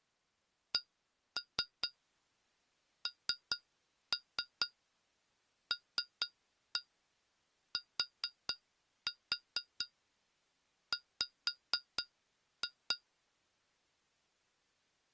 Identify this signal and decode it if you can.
Tap code, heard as taps on glass, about 4 knocks a second. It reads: CNLTW